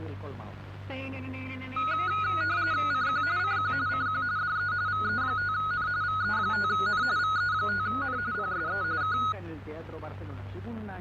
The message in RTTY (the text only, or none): CQ CQ CQ DE VE5N VE5N VE5N PSE K